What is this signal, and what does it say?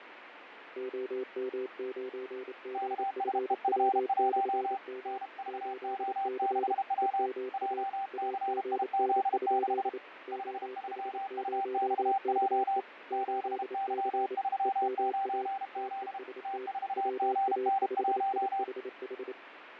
Morse code, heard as two keyed tones, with radio static and fading. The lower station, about 28 wpm, 390 Hz: OM9GFW/M 8C EMA AGN? OH0KE 8C EMA TEST WA5IHH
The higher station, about 32 wpm, 780 Hz: KSEF1 NVO6W JCIZ6 53UXJ 7Y39Z T4GN1